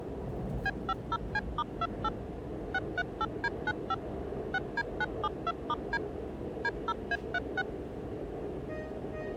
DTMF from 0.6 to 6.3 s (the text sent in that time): B50C*28 638D95 6D972*D